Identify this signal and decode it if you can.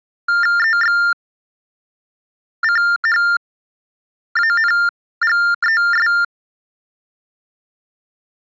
TTY/TDD text telephone tones (45.45 baud Baudot), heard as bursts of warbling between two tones, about 400 Hz shift, 1600 Hz centre. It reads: EXCHANGES